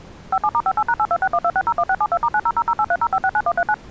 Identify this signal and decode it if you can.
DTMF, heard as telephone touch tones, dialled by machine, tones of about 60 ms. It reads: 57*58#82612601672*9000830569139